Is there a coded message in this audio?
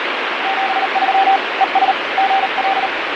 Yes: Morse code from 0.4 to 2.9 s, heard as a keyed tone, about 38 wpm, 780 Hz, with heavy radio static and fading. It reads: 73 ES GL